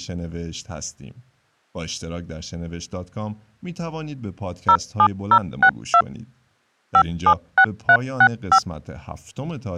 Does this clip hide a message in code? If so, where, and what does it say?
Yes: DTMF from 4.7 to 8.6 s, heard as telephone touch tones, dialled by machine, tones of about 70 ms, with speech in Persian. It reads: 07062 576365